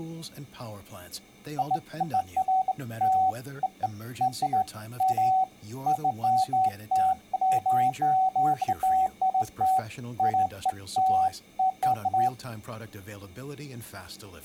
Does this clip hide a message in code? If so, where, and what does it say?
No, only beeps of irregular length, with speech in English.